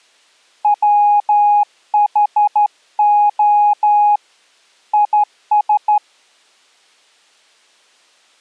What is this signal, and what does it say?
Morse code, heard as a keyed tone, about 12 wpm, 830 Hz. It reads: WHO IS